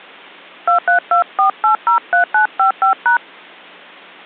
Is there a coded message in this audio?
Yes: DTMF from 0.7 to 3.2 s, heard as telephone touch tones, dialled by hand, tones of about 110 ms. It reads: 2324803955#